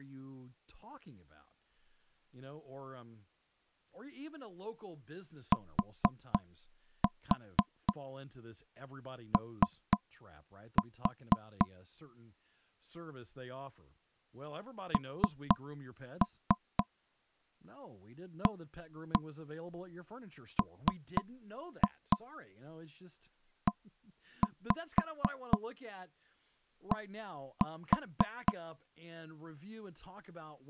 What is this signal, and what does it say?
Tap code, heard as knocks on wood, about 4 knocks a second, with speech in English. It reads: TO NAMED